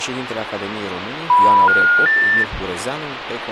Telephone call progress tone (North American plan), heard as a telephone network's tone, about 980, 1430, 1800 Hz, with phone line noise. Special information tone.